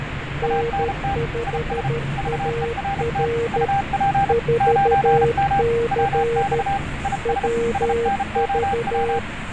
Morse code, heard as two keyed tones, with radio static, fading and the noise inside a subway train. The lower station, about 13 wpm, 470 Hz: N5AR 4C WV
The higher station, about 33 wpm, 790 Hz: ANT IS VERT UP 9M WX IS SNOW